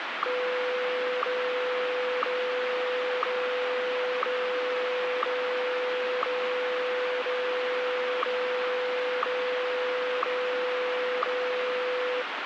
Radio time signal (WWVH, Hawaii), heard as ticks, one a second, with radio static.